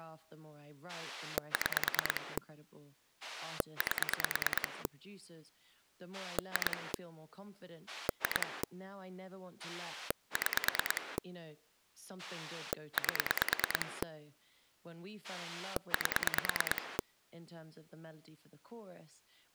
Pulse dialling, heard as a rotary dial, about 9 pulses a second, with speech in English. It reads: 6 8 2 2 6 8 8